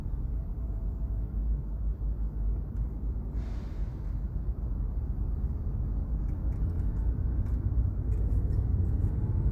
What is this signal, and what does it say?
The noise inside a car. There is no code.